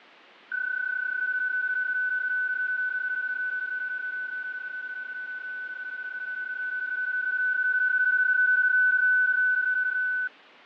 PSK31 (31.25 baud), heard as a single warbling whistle, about 1500 Hz, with fading.